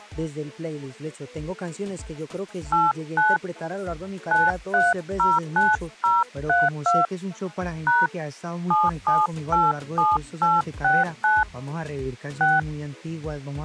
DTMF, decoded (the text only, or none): 89 9309032 # 7787869 6